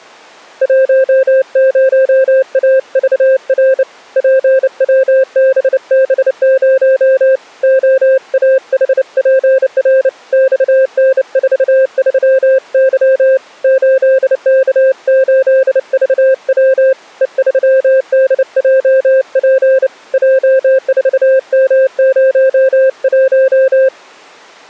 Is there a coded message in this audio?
Yes: Morse code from 0.6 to 23.9 s, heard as a keyed tone, hand-sent with a bug key, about 29 wpm, 530 Hz. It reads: 10AVR PWBB0 OAHPR XN43Y 8K8VW E3DJP J4M01